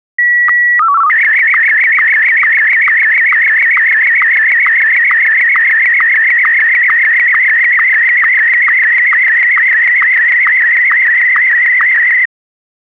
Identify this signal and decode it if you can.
SSTV (slow-scan television), Martin M1, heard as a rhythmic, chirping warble.